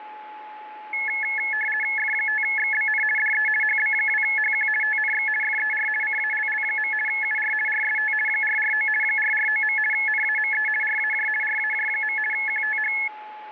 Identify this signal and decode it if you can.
RTTY (50 baud, 450 Hz shift), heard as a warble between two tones, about 1950 Hz centre, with a steady whistle near 850 Hz. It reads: F5XBN DE HB2HQ TNX FER CALL. UR RST 449 449. NAME RAJ RAJ. QTH